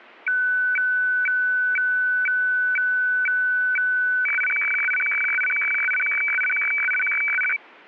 Weather fax (radiofax), 120 lines a minute, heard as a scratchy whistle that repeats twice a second.